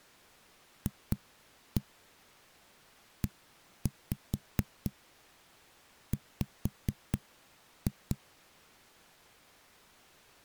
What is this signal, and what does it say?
Tap code, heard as knocks on a wall, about 4 knocks a second. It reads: FEW